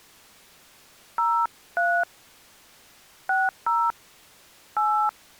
DTMF, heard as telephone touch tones, dialled by hand, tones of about 290 ms. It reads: 03 60 8